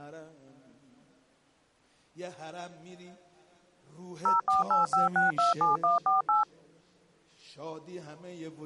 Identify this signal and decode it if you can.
DTMF, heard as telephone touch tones, dialled by machine, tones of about 150 ms. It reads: 0485627148